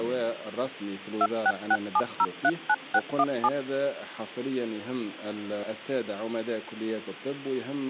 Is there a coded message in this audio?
Yes: DTMF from 1.2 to 3.5 s, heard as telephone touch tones, dialled by machine, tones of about 50 ms, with hum. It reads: 2667039617